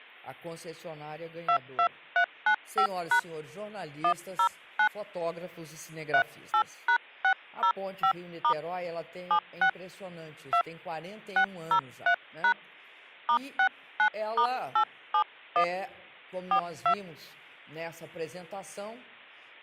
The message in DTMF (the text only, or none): 22395# 109 38#605* 76 2 603# *69*871 42